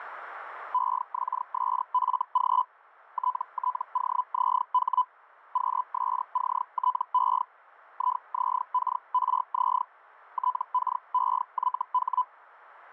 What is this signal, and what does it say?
Hellschreiber (Feld-Hell, 122.5 baud), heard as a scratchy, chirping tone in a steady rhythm, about 1000 Hz. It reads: EXSFG TTOZH QSCTE IZKRZ TKEYH